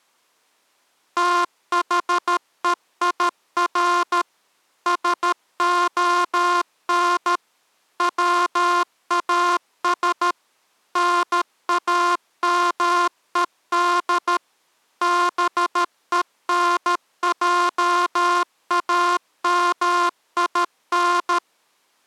Morse code, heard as a buzzer, machine-sent, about 13 wpm. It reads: THEIR SON WAS NAMED BENJAMIN